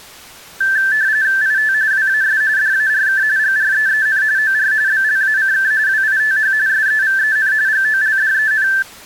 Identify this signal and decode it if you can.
RTTY (45.45 baud, 170 Hz shift), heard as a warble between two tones, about 1650 Hz centre. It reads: IT WAS DARK GREEN OR BLACK WITH SEVEN GOLDEN